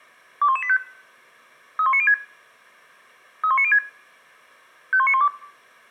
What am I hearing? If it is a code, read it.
Five-tone selective call (ZVEI), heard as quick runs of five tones, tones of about 70 ms. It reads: 21185 31906 31906 51912